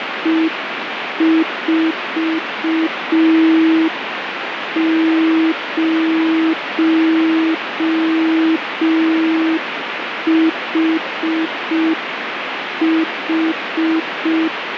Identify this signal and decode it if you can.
Morse code, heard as a keyed tone, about 5 wpm, 320 Hz, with radio static. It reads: E40HH